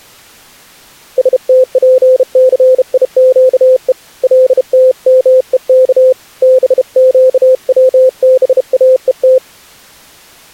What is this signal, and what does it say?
Morse code (Hebrew alphabet), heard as a keyed tone, hand-sent with a bug key, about 32 wpm, 520 Hz. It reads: שתפסיקו לתמוך בקצבאות